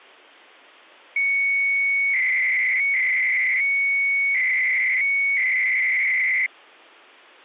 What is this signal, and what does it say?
300-baud modem data (Bell 103 tones), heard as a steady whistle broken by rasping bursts, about 300 baud, 200 Hz shift.